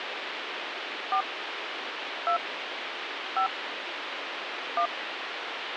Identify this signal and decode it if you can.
DTMF, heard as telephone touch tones, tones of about 90 ms, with phone line noise. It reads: 4 2 5 1